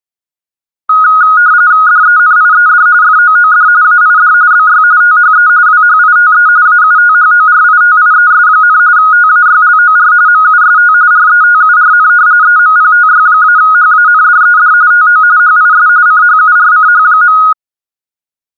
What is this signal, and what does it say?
RTTY (45.45 baud, 170 Hz shift), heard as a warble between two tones, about 1350 Hz centre. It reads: DENIED FOOD AID BY THE WHITE AUTHORITIES, TAYLOR MUST RETURN EMPTY-HANDED TO HIS CHURCH.